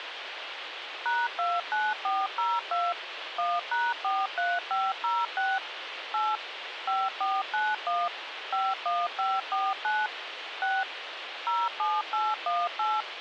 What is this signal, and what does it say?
DTMF, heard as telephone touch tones, dialled by machine, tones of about 210 ms, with radio hiss. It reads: #29402 1#43506 8 5491 51549 6 07818